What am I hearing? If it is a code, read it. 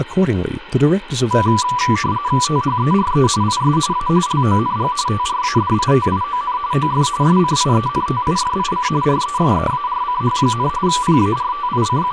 RTTY (45.45 baud, 170 Hz shift), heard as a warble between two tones, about 1080 Hz centre, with radio static and speech in English. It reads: THERE IS A LONG TRADITION OF SCIENTIFIC RESEARCH, …